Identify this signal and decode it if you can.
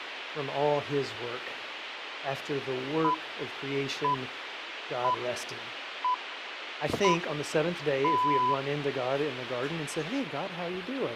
Radio time signal (six pips, as the Greenwich Time Signal), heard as pips, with radio hiss and a squelch burst at the end.